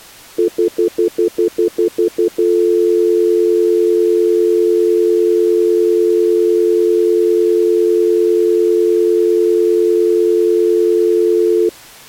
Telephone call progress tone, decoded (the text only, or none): stutter dial tone